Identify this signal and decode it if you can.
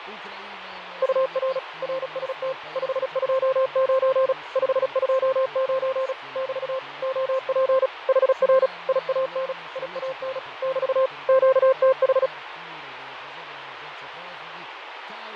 Morse code, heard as a keyed tone, machine-sent, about 36 wpm, 530 Hz, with radio static and fading. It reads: UR RST 529 529 <BT> OP HR IAN IAN <BT> QTH